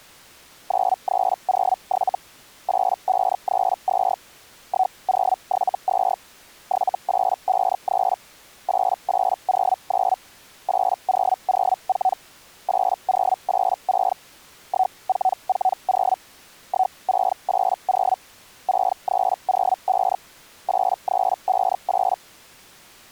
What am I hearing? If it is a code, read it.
Hellschreiber (Feld-Hell, 122.5 baud), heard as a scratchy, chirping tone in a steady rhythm, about 750 Hz. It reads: 9307 8532 1072 7853 8809 8004 8086 1440 1680 6305 8358